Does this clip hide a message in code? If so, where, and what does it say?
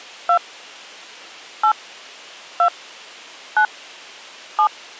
Yes: DTMF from 0.3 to 4.7 s, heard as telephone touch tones, dialled by hand, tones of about 80 ms. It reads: 2 8 2 9 7